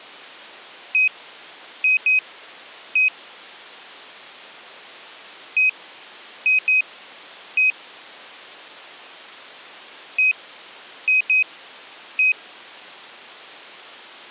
Beep code, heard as a piezo beeper, played three times, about 2500 Hz. 1-2-1. In Phoenix BIOS tables: interval timer failure.